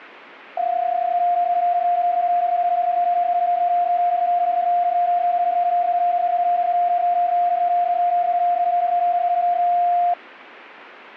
PSK31 (31.25 baud), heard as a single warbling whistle, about 700 Hz.